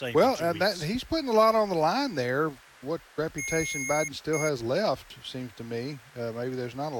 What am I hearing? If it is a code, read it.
Beep code, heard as beeps from a small speaker, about 2150 Hz, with speech in English. 1 long, 1 short. In IBM BIOS tables: system board problem.